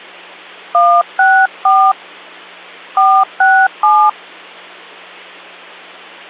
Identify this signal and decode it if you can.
DTMF, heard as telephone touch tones, dialled by hand, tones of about 270 ms, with hum. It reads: 164 467